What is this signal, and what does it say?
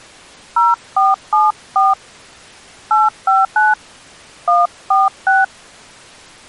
DTMF, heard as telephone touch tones, dialled by hand, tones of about 180 ms. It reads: 0474 859 146